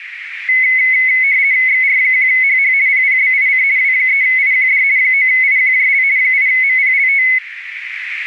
RTTY (50 baud, 170 Hz shift), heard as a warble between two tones, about 2100 Hz centre, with radio static and a narrow filter. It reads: XR1HH PPBIC W3IQD 9IQJL 8MPLT